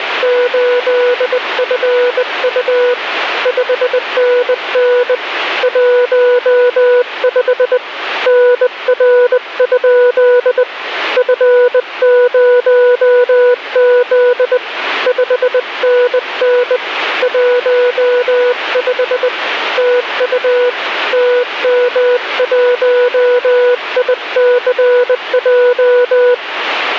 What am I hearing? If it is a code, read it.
Morse code, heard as a keyed tone, hand-sent with a bug key, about 20 wpm, 490 Hz, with radio static. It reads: … 5NN 15 NR? F0Z 5NN 15 TU TM1ICJ